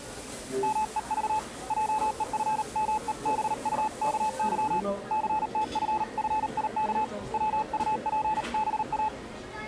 Morse code (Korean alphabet), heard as a keyed tone, hand-sent with a paddle, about 38 wpm, 860 Hz, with the noise of a restaurant. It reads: 말 한마디에 천냥 빚도